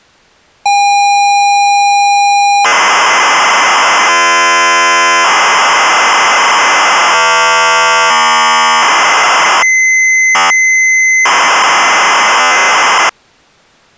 ZX Spectrum tape loading, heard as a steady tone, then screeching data.